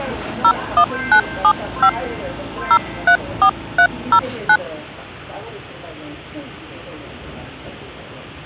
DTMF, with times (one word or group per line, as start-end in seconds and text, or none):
0.4-1.9 01975
2.7-4.6 034309